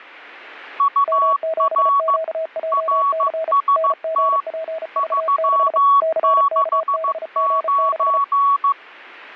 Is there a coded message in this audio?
Yes: Morse code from 0.7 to 8.8 s, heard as two keyed tones. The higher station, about 15 wpm, 1120 Hz: UR RST 369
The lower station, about 34 wpm, 640 Hz: M7QJC NGPV6 CKBG6